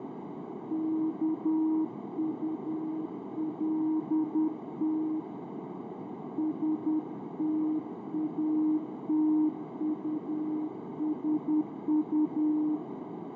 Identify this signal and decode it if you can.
Morse code, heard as a keyed tone, hand-sent with a paddle, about 10 wpm, 310 Hz, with heavy radio static, fading and a narrow filter. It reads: KULT STATUSU